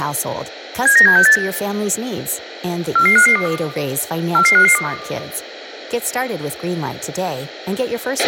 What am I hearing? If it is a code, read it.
Five-tone selective call (CCIR), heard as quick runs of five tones, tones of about 100 ms, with a squelch burst at the end, room echo and speech in French. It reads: 79768 44552 44552